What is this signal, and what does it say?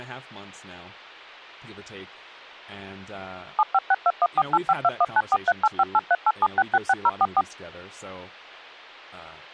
DTMF, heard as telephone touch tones, dialled by machine, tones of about 40 ms, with speech in English. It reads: 7562148521943858387666044